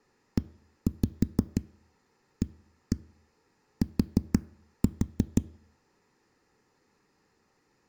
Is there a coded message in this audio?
Yes: tap code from 0.4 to 5.4 s, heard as knocks on a wall, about 6 knocks a second. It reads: EAT